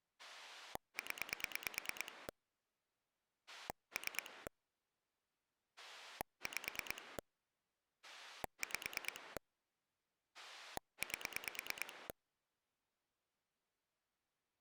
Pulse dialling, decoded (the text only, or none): 0 3 5 5 8